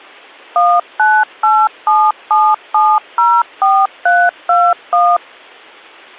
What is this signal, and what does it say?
DTMF, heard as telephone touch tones, dialled by machine, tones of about 240 ms. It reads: 19877704321